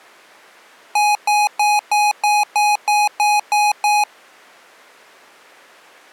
Beep code, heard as beeps from a small speaker, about 830 Hz. 10 short. In AMI BIOS tables: CMOS shutdown register error.